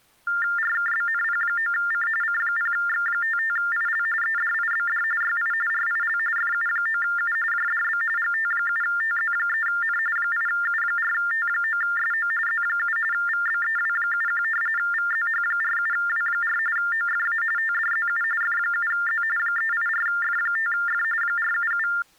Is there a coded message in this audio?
Yes: TTY/TDD text telephone tones (45.45 baud Baudot) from 0.3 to 22.0 s, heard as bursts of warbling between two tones, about 400 Hz shift, 1600 Hz centre. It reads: RKBNP9C C0X55IL EDIBD YI RIL FU9U JDB GT7TZ3N 8U4T9SO Z7 VBEW71 VZH47W4 OFA TDZU F7Z 384F5F 477